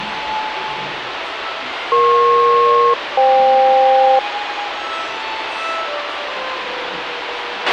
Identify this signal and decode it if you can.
Aircraft SELCAL, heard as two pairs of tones, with radio hiss and a squelch burst at the end. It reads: EP-FK